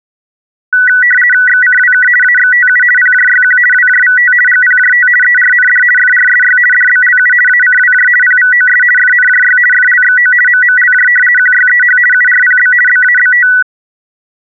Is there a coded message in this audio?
Yes: RTTY (50 baud, 450 Hz shift) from 0.7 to 13.6 s, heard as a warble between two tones, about 1700 Hz centre. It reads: XCWK AXTU PJYQ WJVT GPJT ERND FRSY DBLU ACWJ PVOS FNJY FLXO MMLJ QYEH URPB BABT